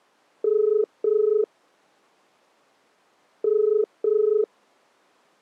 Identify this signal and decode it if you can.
Telephone call progress tone (as in the UK, Ireland, Australia and similar networks), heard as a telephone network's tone, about 430 Hz. Ringback tone.